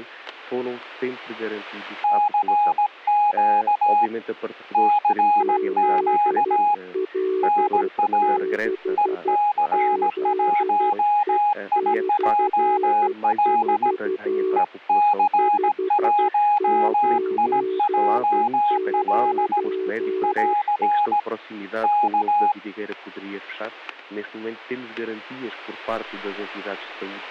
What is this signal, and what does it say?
Morse code, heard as two keyed tones, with static crashes. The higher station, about 17 wpm, 830 Hz: CQ CQ NA EC1IJL EC1IJL <AR> K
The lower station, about 12 wpm, 380 Hz: ZL6ZE/4 599